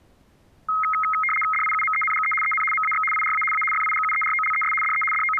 RTTY (75 baud, 850 Hz shift), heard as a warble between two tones, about 1700 Hz centre. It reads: DIUMENGE EN MAX IRA A FIGUEROLES DE …